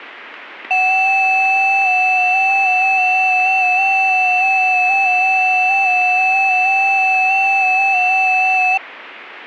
FT8 (several signals at once), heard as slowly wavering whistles, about 6.25 baud, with radio static.